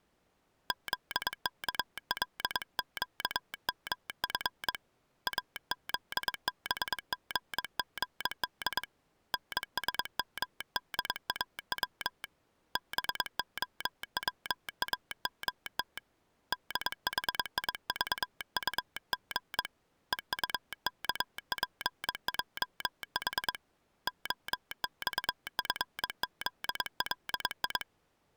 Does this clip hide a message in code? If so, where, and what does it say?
Yes: Morse code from 0.6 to 27.9 s, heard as a telegraph sounder, hand-sent with a paddle, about 22 wpm. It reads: ZKLQMF AZBGGD NSMDAW BOWAMT DHIVUG EUKPJH OXFZLI